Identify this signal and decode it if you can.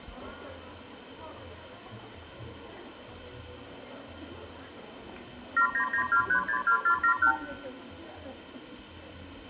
Multi-frequency trunk signalling (R2, with the far end's replies), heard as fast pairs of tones, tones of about 90 ms, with room echo and the noise of a crowd indoors. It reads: 7992362471